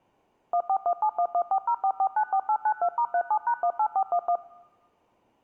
DTMF, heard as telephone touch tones, dialled by machine, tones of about 70 ms. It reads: 141711404494892*37#18411